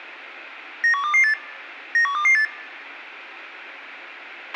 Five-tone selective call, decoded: 91228 91228

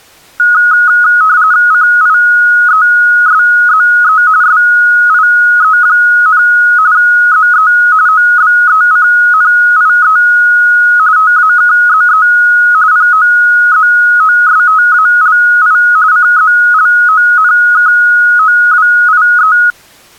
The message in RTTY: CIESZE SIE, ZE OBECNIE TAKZE POZOSTALI CZLONKOWIE

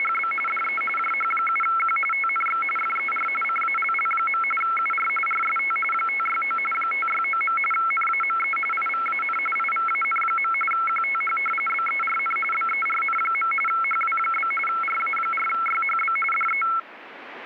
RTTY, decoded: … DE JH7Q TNX FER CALL. UR RST 569 569. NAME IVAN IVAN. QTH BERN BERN. HW? RA4YHB DE

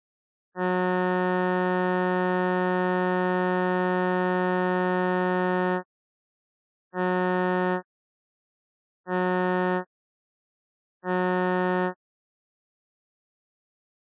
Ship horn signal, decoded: 1 long, 3 short

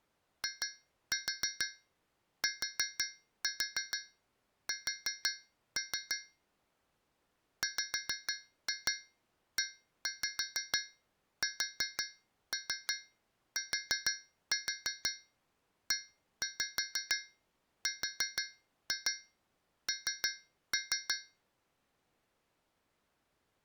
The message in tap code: ITS WESTERN

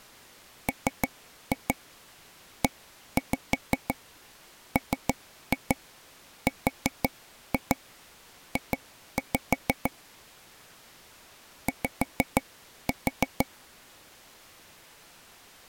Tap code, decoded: MEMRJ Y

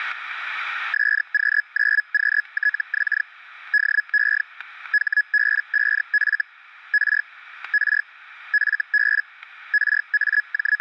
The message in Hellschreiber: SQ9QTX DE HB5F R R FB …

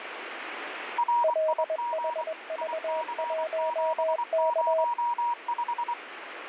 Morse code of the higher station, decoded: RIG IC705

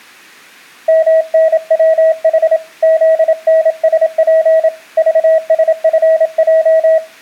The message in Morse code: MNWH ZNSP VSFJ

